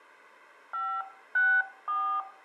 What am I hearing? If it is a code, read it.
DTMF, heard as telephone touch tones, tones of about 260 ms, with room echo. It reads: 564